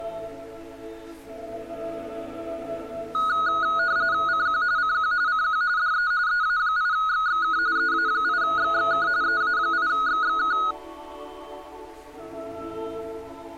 RTTY (45.45 baud, 170 Hz shift), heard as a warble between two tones, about 1360 Hz centre. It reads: CQ CQ CQ DE EA8XXK EA8XXK EA8XXK